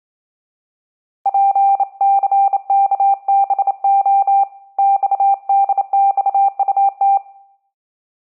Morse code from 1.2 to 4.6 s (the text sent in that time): PCKBO